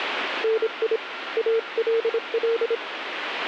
Morse code, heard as a keyed tone, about 26 wpm, 450 Hz, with radio static and a weaker station near 1380 Hz. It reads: NI ALL